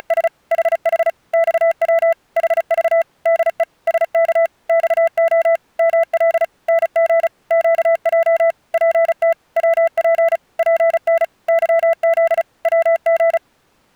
Morse code, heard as a keyed tone, machine-sent, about 35 wpm, 660 Hz. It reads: … HH XW HV DE SK XO ML NG QJ PT WP PN YZ WG